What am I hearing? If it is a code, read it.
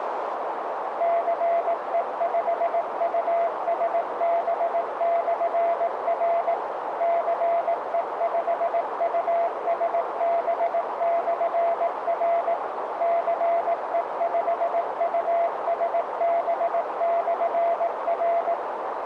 Morse code, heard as a keyed tone, machine-sent, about 18 wpm, 680 Hz, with radio static and a narrow filter. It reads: CE5USB/R CE5USB/R CE5USB/R